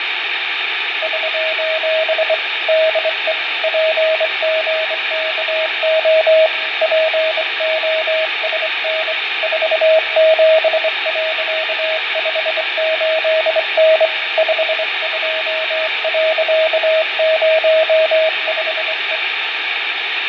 Morse code, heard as a keyed tone, hand-sent with a straight key, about 24 wpm, 640 Hz, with radio static, fading and room echo. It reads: <SOS> DE PGKO POSN 47.58N 52.05E